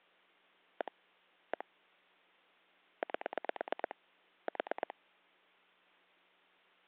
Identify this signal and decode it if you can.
Pulse dialling, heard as clicks on a phone line, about 9 pulses a second. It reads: 1 1 8 4